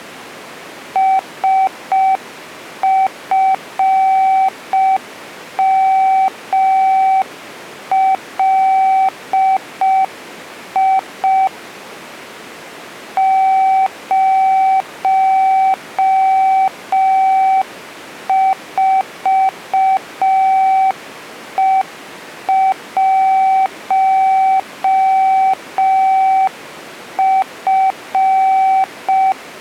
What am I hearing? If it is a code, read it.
Morse code, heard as a keyed tone, hand-sent with a paddle, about 5 wpm, 770 Hz. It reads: SFMLI 04E1F